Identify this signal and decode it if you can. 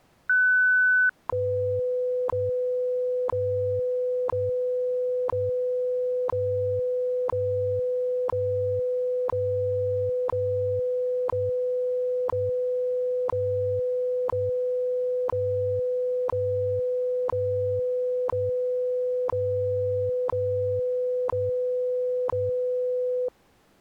Radio time signal (WWV, Colorado), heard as ticks, one a second.